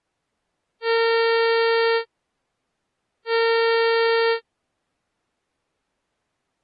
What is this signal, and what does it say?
Ship horn signal, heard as a ship's horn, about 460 Hz. 2 short. At sea: I am altering course to port.